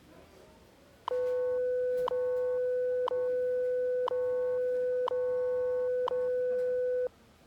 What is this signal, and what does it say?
Radio time signal (WWV, Colorado), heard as ticks, one a second, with the noise of a restaurant.